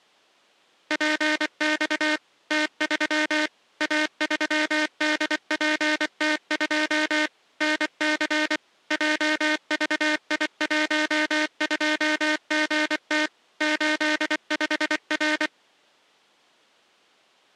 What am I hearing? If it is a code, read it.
Morse code, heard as a buzzer, machine-sent, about 24 wpm. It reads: PX T3 A3DPT2 NC JVI12GT 85R